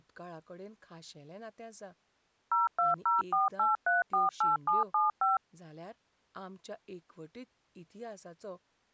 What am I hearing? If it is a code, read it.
DTMF, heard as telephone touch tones, dialled by machine, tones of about 160 ms, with speech in Goan Konkani. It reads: 02048348775